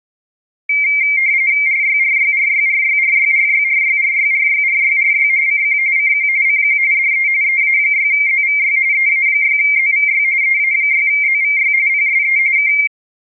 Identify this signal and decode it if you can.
RTTY (45.45 baud, 170 Hz shift), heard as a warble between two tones, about 2200 Hz centre. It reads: RYRYRYRYRYRYRYRYRYRYRY CQ CQ CQ DE EA6ZVY EA6ZVY EA6ZVY PSE K